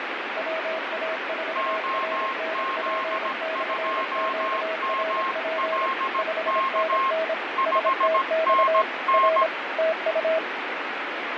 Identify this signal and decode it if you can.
Morse code, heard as two keyed tones, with heavy radio static and fading. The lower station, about 26 wpm, 640 Hz: WA4RNP/QRP 5NN STX R TU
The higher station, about 17 wpm, 1070 Hz: OZ2MLK 5NN